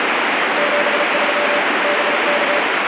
Morse code, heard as a keyed tone, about 34 wpm, 580 Hz, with heavy radio static. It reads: 73 BK